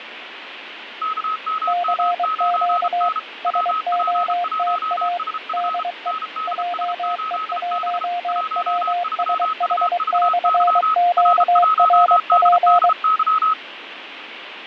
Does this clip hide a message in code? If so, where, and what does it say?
Yes: Morse code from 1.0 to 13.6 s, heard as two keyed tones, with radio static and fading. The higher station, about 33 wpm, 1280 Hz: KMM9N WP1SF NDS8B 13UVY R1DDY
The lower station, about 23 wpm, 700 Hz: CQ SOTA DE JE1WSH/QRP